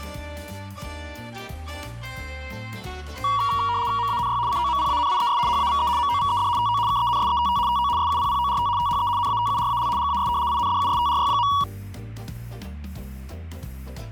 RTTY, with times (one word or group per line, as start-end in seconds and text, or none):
4.0-4.4 MANY
4.5-5.4 COMPANIES
5.5-5.9 HAVE
6.0-6.5 MOVED
6.6-6.8 TO
6.9-7.6 KENSETT
7.7-7.9 TO
8.0-8.7 SUPPORT
8.8-9.1 THE
9.2-9.9 NATURAL
10.0-10.3 GAS
10.5-11.5 INDUSTRY.